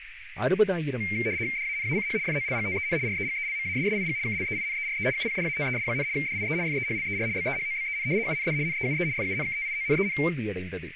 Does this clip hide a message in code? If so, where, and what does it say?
Yes: RTTY (75 baud, 170 Hz shift) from 1.0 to 10.3 s, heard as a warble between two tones, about 2200 Hz centre, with radio static, a narrow filter and speech in Tamil. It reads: DANACH FOLGTEN REGELMASSIG KLEINERE UPDATES, DIE FEHLER BEHOBEN UND NEUE FUNKTIONEN